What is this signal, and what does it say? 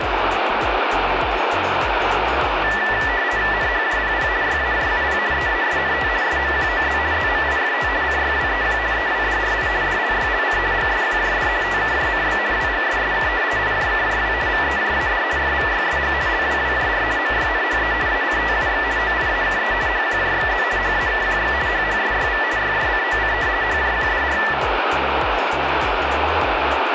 RTTY (50 baud, 170 Hz shift), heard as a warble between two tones, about 1850 Hz centre, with radio static. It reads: NHJPP YAJUP EASNT SMQOZ ZMIFT CYWEQ EWDRI DLYLC GSQJD TKJCB WGSSK IJKJW VEJAD FVYSG LWWJR MYNHE ACTUX OIAKE HQJXZ HAKQX HHSYV YJCOC HJQDR